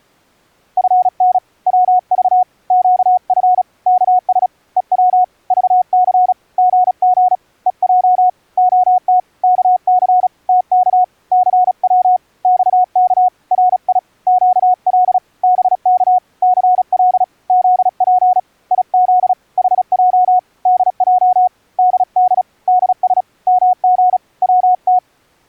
Morse code, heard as a keyed tone, hand-sent with a paddle, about 36 wpm, 730 Hz. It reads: FN WV QF KS EW VC GG EJ OT KC TK CW XK RI QL BK CL ZP IZ HJ DJ DD DS MG WT